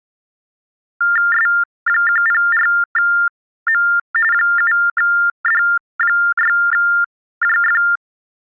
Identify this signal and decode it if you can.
TTY/TDD text telephone tones (45.45 baud Baudot), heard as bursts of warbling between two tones, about 400 Hz shift, 1600 Hz centre. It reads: S104M 7D6JF